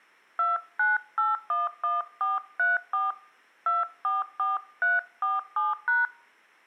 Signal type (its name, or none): DTMF